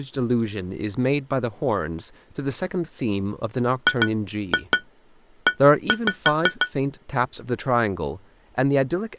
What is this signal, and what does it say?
Tap code, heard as taps on glass, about 6 knocks a second, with speech in English. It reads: GE